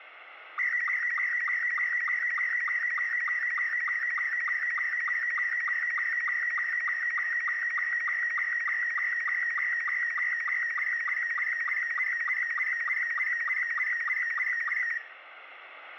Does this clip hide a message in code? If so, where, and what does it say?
Yes: SSTV (slow-scan television), Robot 72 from 0.6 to 15.0 s, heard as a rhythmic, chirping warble, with radio static and room echo.